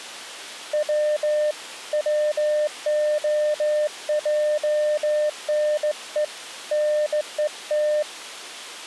Morse code (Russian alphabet), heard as a keyed tone, hand-sent with a straight key, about 16 wpm, 600 Hz. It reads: В ВОЙНЕ НЕТ